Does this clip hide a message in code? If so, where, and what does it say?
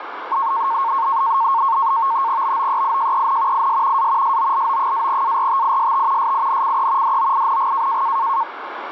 Yes: NAVTEX (SITOR-B), 100 baud, 170 Hz shift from 0.3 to 8.4 s, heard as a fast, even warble, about 1000 Hz centre, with radio static. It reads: BOEIJEN IS A SOLO-ARTIST SINCE DOING